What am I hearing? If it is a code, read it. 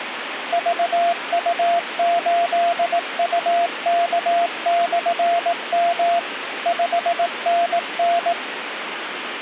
Morse code, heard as a keyed tone, machine-sent, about 18 wpm, 690 Hz, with radio static. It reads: VU8UK/M 5NN